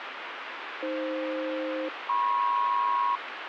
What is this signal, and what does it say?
Aircraft SELCAL, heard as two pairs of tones, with radio static. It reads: AF-MP